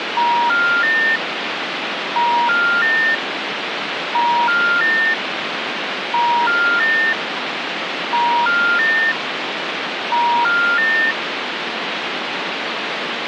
Telephone call progress tone (ITU plan), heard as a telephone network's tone, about 950, 1400, 1800 Hz, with phone line noise. Special information tone.